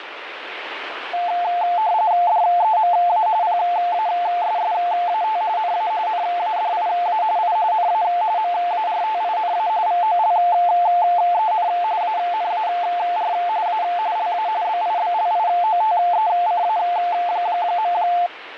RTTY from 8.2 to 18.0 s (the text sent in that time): MARTINA VOLEN ANAR A LA BIBLIOTECA.